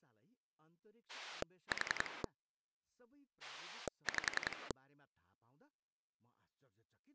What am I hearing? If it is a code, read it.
Pulse dialling, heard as a rotary dial, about 10 pulses a second, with speech in Nepali. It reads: 4 5